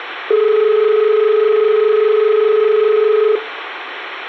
Telephone call progress tone (as in Australia), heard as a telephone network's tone, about 430 Hz. Dial tone.